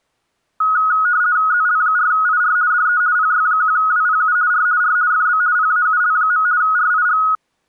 RTTY (50 baud, 170 Hz shift), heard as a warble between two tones, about 1360 Hz centre. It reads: ZL4IR DE PY1WPU R R FB PAUL. RIG